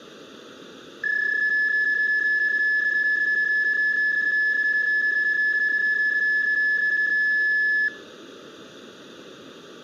PSK31 (31.25 baud), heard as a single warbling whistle, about 1700 Hz.